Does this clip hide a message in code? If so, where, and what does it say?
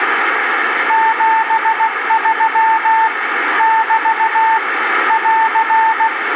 Yes: Morse code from 0.8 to 6.1 s, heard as a keyed tone, machine-sent, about 16 wpm, 890 Hz, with radio static. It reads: 73 <BT> <AR>